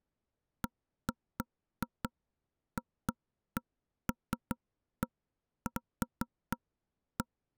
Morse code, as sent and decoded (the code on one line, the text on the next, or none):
none